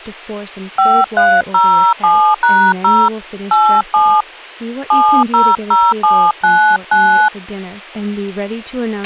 DTMF, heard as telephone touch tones, dialled by hand, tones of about 300 ms, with a squelch burst at the end and speech in English. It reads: 5307#0 87 700799